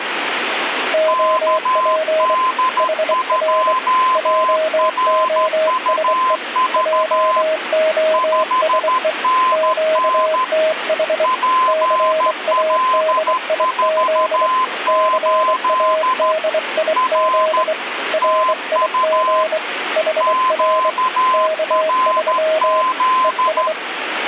Morse code, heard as two keyed tones, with radio static. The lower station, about 24 wpm, 630 Hz: OP HR JOSE JOSE QTH CADIZ CADIZ RIG HR K3 ES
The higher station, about 13 wpm, 1030 Hz: KD2RUV 5NN PL48 R TU QRZ